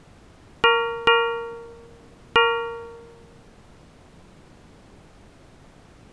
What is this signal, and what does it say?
Ship's bell, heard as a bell. 3. Three half-hours of the watch have passed.